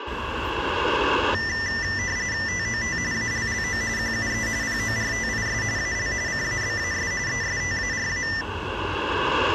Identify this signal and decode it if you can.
RTTY (45.45 baud, 170 Hz shift), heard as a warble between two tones, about 1900 Hz centre, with street noise. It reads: TOT ALLO QUE PORTIS AL CABAS ESTARA